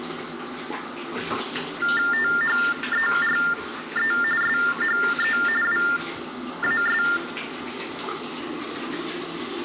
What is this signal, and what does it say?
TTY/TDD text telephone tones (45.45 baud Baudot), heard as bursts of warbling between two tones, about 400 Hz shift, 1600 Hz centre, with room echo and the noise of a restroom. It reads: THERE SHE WAS